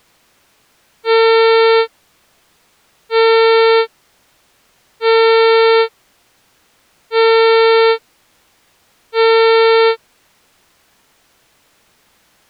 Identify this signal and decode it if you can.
Ship horn signal, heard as a ship's horn, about 450 Hz. 5 short. At sea: I doubt that you are doing enough to avoid a collision.